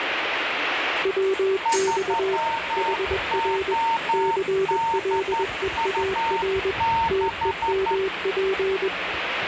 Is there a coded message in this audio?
Yes: Morse code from 1.0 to 8.9 s, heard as two keyed tones, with radio static and the noise of a subway station. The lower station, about 21 wpm, 380 Hz: WX HR CLEAR TEMP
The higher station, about 11 wpm, 910 Hz: 3ODU6